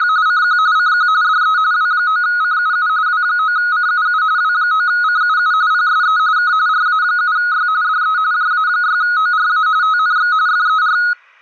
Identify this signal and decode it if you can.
RTTY (45.45 baud, 170 Hz shift), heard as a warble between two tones, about 1360 Hz centre. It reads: … CQ CQ DE W9CUU W9CUU W9CUU PSE K RA7Y DE JA6ORA TNX FER